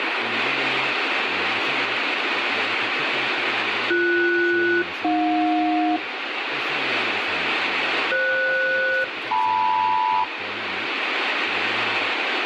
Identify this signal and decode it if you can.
Aircraft SELCAL, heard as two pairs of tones, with radio static. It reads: BS-AJ FS-LM